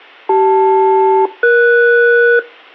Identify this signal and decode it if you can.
Aircraft SELCAL, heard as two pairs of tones. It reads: CL-ES